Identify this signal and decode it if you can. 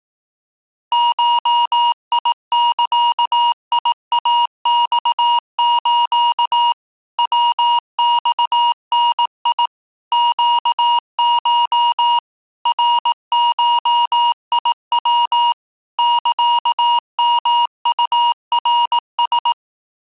Morse code (Japanese Wabun code), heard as electronic beeps, machine-sent, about 18 wpm, 950 Hz. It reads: ゴザイマス ヤマダ ネコ ナゴヤ サヨウナラ